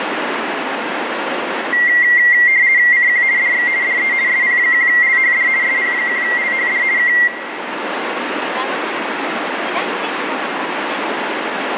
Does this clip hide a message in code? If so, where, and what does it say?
Yes: RTTY (50 baud, 170 Hz shift) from 1.7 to 7.3 s, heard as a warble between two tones, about 2000 Hz centre, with radio static and room echo. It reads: CQ DX DE SP1LHD SP1LHD K